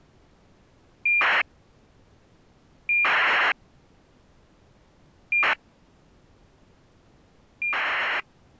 ACARS aircraft data, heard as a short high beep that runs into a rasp, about 2400 baud.